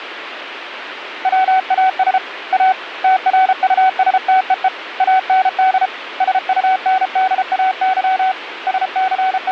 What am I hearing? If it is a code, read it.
Morse code, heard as a keyed tone, hand-sent with a paddle, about 33 wpm, 760 Hz, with radio static. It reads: WAS A TRUSTEE AND SUNDAY …